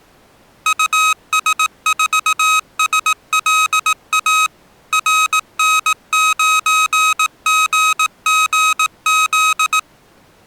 Morse code, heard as electronic beeps, machine-sent, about 18 wpm, 1270 Hz. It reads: US4SLA RN9GGZ